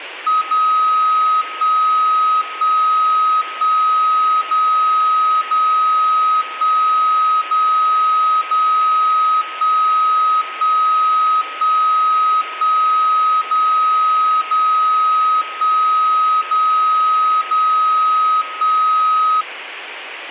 Radio time signal (DCF77), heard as a tone whose level steps once a second, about 1270 Hz. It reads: 0 1 1 1 0 0 1 0 0 1 1 1 1 0 0 1 0 0 1